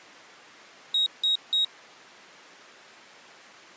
Beep code, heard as a piezo beeper, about 3800 Hz. 3 short. In AMI BIOS tables: failure in the first 64 KB of memory; in Dell tables: chipset error.